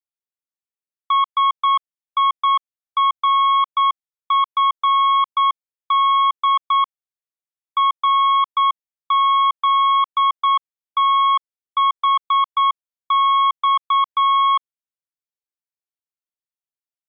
Morse code, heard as a keyed tone, machine-sent, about 9 wpm, 1100 Hz. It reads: SIRFD RZTHX